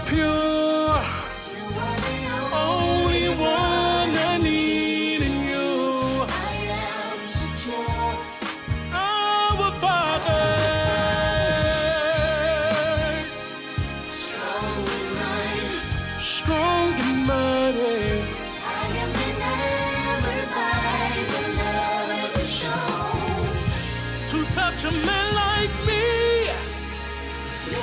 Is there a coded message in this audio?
No.